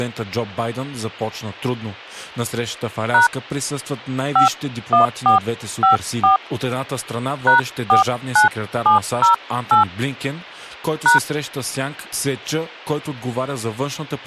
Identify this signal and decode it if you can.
DTMF, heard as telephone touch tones, dialled by hand, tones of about 130 ms, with speech in Bulgarian. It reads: # 51454 #49708 #